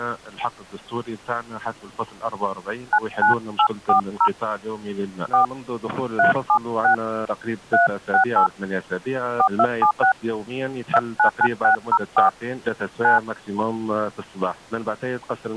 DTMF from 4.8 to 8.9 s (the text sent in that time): 4 376 368